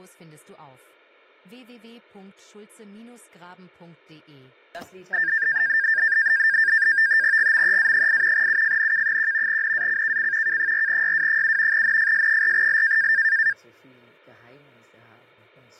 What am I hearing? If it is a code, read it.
NAVTEX (SITOR-B), 100 baud, 170 Hz shift, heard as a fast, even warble, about 1700 Hz centre. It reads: GMEA8 UFNK1 NACKC K4YW7 NFS4L